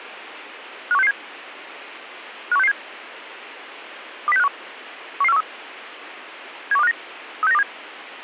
Five-tone selective call (EEA), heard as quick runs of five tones, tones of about 40 ms, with radio hiss. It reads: 51667 51667 20651 11413 71259 36927